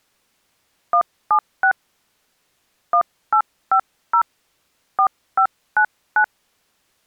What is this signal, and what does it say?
DTMF, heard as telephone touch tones, dialled by hand, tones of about 80 ms. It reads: 176 1850 4599